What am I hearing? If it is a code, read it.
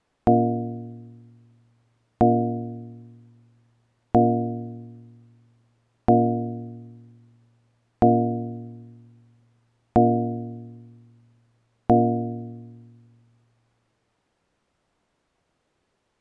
Clock strike, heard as a bell. 7. Seven o'clock.